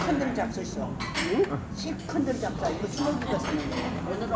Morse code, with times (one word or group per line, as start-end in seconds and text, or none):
none